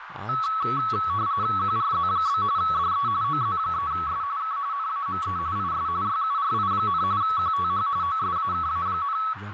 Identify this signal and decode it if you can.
RTTY (45.45 baud, 170 Hz shift), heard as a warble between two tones, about 1210 Hz centre, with radio static, a narrow filter and speech in Urdu. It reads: QRZ? DE OZ3S K NAME IS YURI, QTH OSAKA,